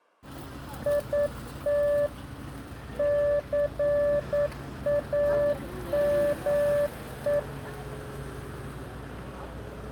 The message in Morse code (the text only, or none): IT CAME